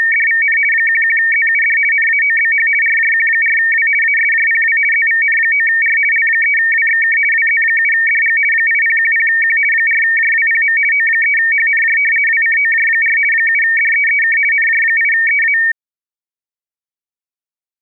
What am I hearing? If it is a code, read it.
RTTY (50 baud, 450 Hz shift), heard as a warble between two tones, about 2050 Hz centre. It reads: … 11ZUD NAOBH RJQ4W ASJPW ZVN9R L3WXK WZ7DG 8010Q 4JWPM O3HNJ WCOJ4 7DEEK NJ8EA